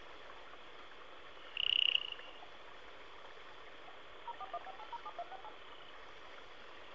DTMF, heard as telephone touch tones, dialled by machine, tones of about 40 ms, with phone line noise. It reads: 0415807268